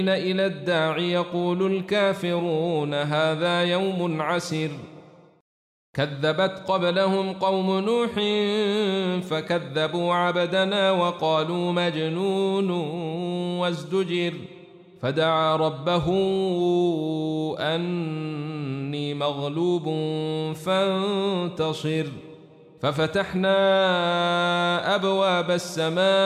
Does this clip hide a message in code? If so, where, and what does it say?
No.